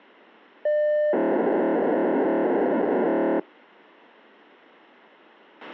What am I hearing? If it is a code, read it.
POCSAG pager data (1200 baud), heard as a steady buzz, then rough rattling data, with a squelch burst at the end.